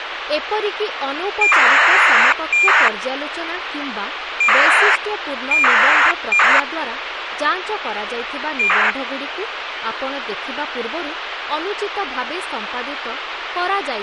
ACARS aircraft data, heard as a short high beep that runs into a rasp, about 2400 baud, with radio hiss and speech in Odia.